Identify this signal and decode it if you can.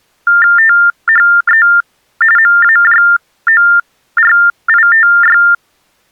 TTY/TDD text telephone tones (45.45 baud Baudot), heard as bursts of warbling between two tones, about 400 Hz shift, 1600 Hz centre. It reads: THE MAJORITY